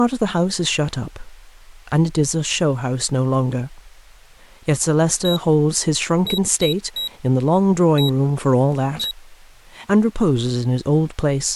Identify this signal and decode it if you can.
Beep code, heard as a piezo beeper, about 3850 Hz, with speech in English. 1-3-1-1. In Phoenix BIOS tables: memory refresh test failure.